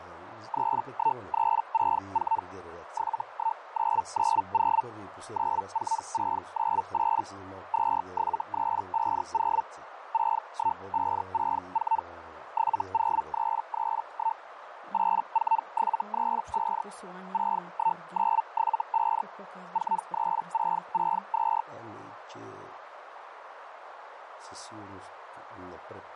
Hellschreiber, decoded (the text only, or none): 31364 71990 94698 27350 61564 70331 84735 61975 43662